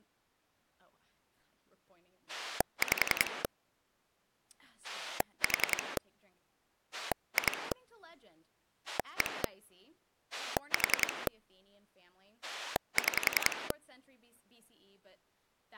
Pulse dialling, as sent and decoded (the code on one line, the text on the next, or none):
5 / 4 / 2 / 1 / 4 / 6
5 4 2 1 4 6